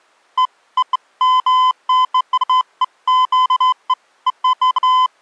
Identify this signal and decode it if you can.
Beeps of irregular length. There is no code.